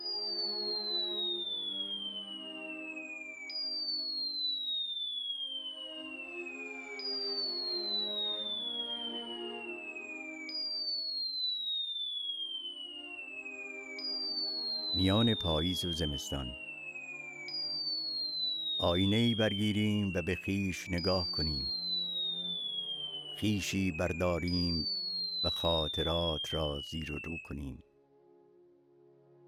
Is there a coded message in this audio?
No, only a tone that sweeps in pitch again and again, with room echo.